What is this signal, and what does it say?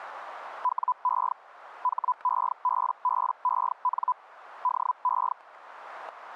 Hellschreiber (Feld-Hell, 122.5 baud), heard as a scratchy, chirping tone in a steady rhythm, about 1000 Hz. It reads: WE HEBBEN DE